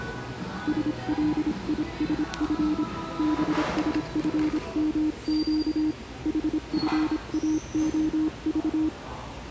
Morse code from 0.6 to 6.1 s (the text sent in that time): SLISF BSFMQ